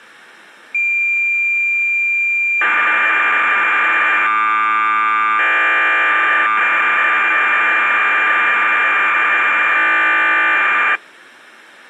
Cassette data (Kansas City type), 1200 baud, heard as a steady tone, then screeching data.